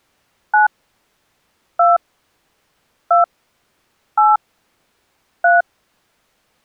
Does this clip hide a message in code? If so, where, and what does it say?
Yes: DTMF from 0.5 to 5.6 s, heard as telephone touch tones, dialled by hand, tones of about 180 ms. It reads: 9 2 2 8 3